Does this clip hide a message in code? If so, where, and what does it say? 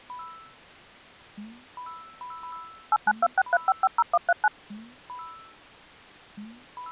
Yes: DTMF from 2.9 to 4.5 s, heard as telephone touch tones, dialled by machine, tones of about 40 ms. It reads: 89263550139